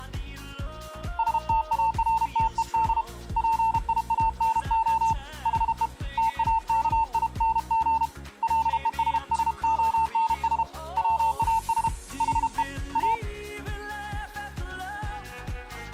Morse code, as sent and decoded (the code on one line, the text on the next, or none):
... - .- .-. - . -.. / .--. .. .- -. --- / .... . / - .- -.- .. -. --. / .-.. . ... ... --- -. ... / .-- .- ... / .... . / .-
STARTED PIANO HE TAKING LESSONS WAS HE A